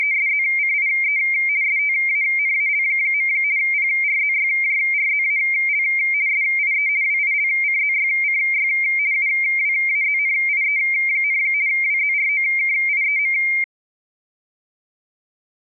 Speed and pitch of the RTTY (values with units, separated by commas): 50 baud, 170 Hz shift, 2200 Hz centre